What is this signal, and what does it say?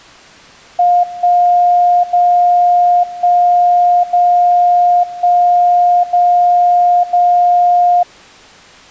Radio time signal (DCF77), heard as a tone whose level steps once a second, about 710 Hz. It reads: 1 0 1 0 1 0 0